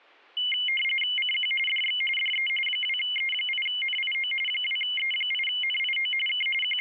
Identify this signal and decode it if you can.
RTTY (45.45 baud, 850 Hz shift), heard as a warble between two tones, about 2550 Hz centre. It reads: CQ DX DE 2E8NIO 2E8NIO K …